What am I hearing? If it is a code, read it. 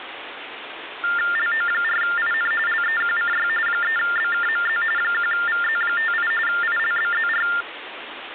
TTY/TDD text telephone tones (45.45 baud Baudot), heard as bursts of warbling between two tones, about 400 Hz shift, 1600 Hz centre, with phone line noise. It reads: LO4IN LEQCY 3BKMZ 1VZ58 ILBZR